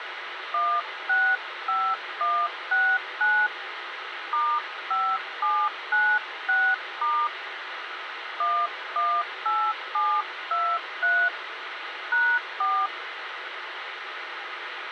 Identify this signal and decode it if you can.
DTMF, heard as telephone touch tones, dialled by hand, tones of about 260 ms, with radio hiss and a squelch burst at the end. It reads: 165169 *5796* 118723 #4